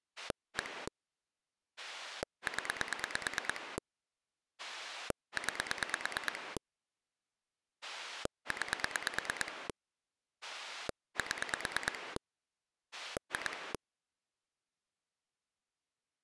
Pulse dialling, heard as a rotary dial, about 9 pulses a second. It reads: 1 0 9 9 7 2